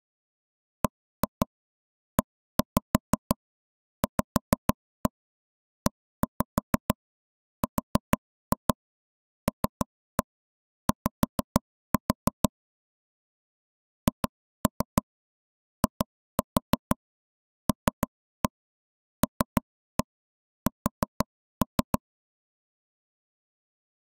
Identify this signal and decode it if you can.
Tap code, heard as taps on a table, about 6 knocks a second. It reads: BEVERLY HILLS